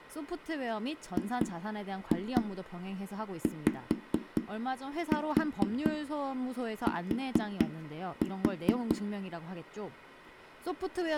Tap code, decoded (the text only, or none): GYT